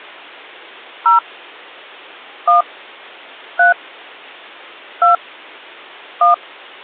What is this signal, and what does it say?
DTMF, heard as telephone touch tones, dialled by hand, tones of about 130 ms. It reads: 0 1 3 2 1